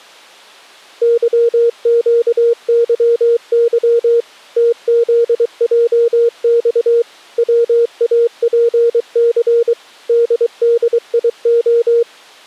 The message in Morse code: YQYY TZJX WAPC DDIO

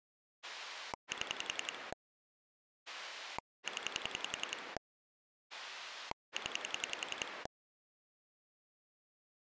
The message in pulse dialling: 7 0 0

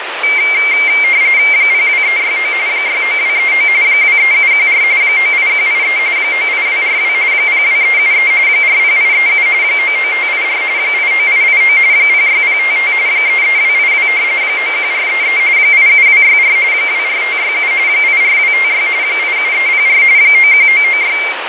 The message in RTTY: 02369 69239 23714 98183 98242 02373 40837 99584 89889 06055 33282 91433 87264 24567 84256 87304 91996

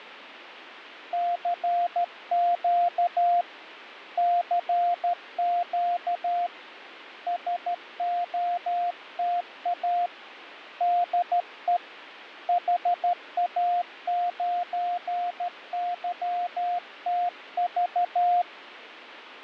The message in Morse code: CQ CQ SOTA DE HA9YTV

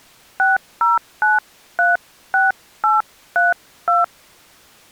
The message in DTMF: 60936832

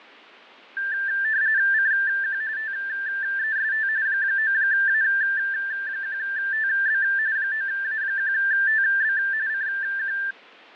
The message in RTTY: CQ TEST 9A1TB 9A1TB CQ

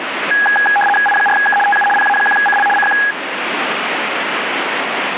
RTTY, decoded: I4K TU PA1CL CQ

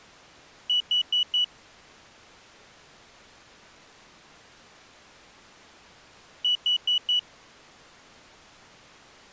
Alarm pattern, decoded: temporal four

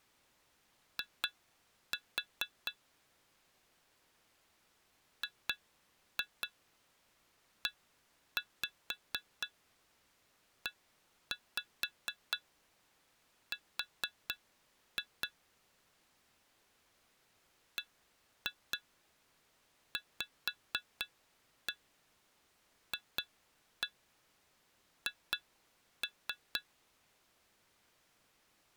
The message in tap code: I GEER BVFH

